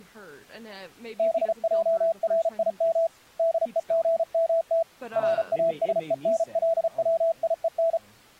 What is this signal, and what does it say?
Morse code (Hebrew alphabet), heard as a keyed tone, hand-sent with a paddle, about 34 wpm, 660 Hz, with speech in English. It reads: בערים דוגמת ראשוןלציון